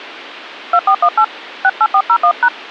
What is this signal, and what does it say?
DTMF, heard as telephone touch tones, dialled by hand, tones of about 70 ms. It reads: 2418 68401#